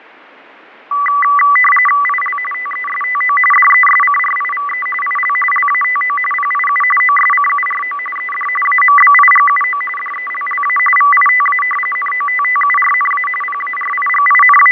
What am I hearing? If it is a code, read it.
RTTY (45.45 baud, 850 Hz shift), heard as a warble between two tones, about 1550 Hz centre, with radio static and fading. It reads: IL TESTO DESCRIVE IL LATO PIU OSCURO ED AMBIGUO DELLA VITA NOTTURNA …